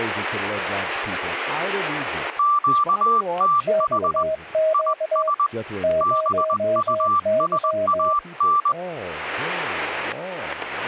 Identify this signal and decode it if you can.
Morse code, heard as two keyed tones, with static crashes and speech in English. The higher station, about 20 wpm, 1170 Hz: QTH IS BUSAN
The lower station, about 20 wpm, 630 Hz: XQ 0Y